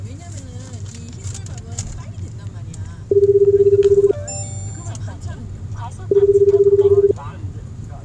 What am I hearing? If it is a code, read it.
Telephone call progress tone (Japanese plan), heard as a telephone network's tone, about 380, 400, 420 Hz, 1 s on and 2 s off, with the noise inside a car. Ringback tone.